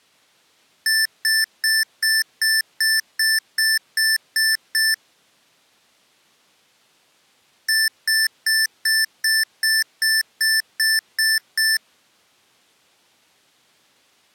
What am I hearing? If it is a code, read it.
Beep code, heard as beeps from a small speaker, played twice, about 1750 Hz. 11 short. In AMI BIOS tables: cache memory error.